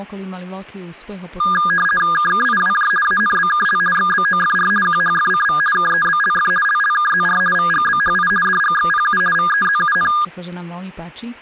RTTY (50 baud, 450 Hz shift), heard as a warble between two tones, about 1430 Hz centre, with speech in Slovak. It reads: KKIWJ ANBKL XBOFR QHFCV KEBLF LLKZR VGBHI DGXPU VEZUN